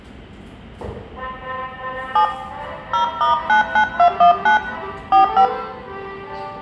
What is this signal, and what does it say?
DTMF, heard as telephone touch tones, dialled by hand, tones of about 100 ms, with room echo and the noise of a subway station. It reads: 7 0*99219 45